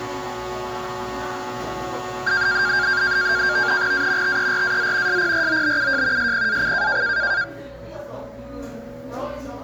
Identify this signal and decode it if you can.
NAVTEX (SITOR-B), 100 baud, 170 Hz shift, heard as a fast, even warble, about 1500 Hz centre, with a steady whistle near 560 Hz and the noise of a cafe. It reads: A TERAZ SPROBUJ SPAC